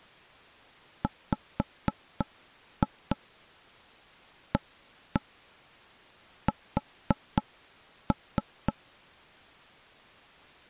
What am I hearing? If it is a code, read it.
Tap code, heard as knocks on wood, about 3 knocks a second. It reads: WAS